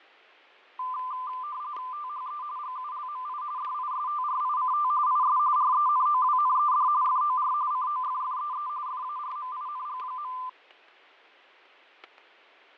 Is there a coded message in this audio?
Yes: RTTY (45.45 baud, 170 Hz shift) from 0.8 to 10.5 s, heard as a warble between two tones, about 1100 Hz centre, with fading and static crashes. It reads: THE GULMI DISTRICT IS RENOWNED FOR COFFEE FARMING.